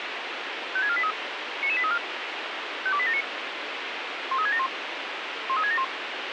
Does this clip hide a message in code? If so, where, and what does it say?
Yes: five-tone selective call (ZVEI) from 0.8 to 5.8 s, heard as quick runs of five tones, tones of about 70 ms, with radio hiss. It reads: 56483 99834 52879 13671 13671